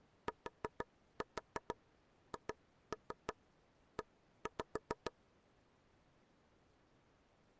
Tap code, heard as taps on a table, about 6 knocks a second. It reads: THE